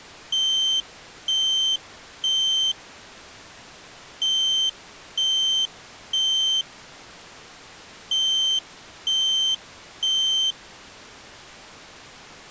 Alarm pattern, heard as an alarm's beeps, played three times, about 3100 Hz. Temporal three. Smoke or fire, evacuate.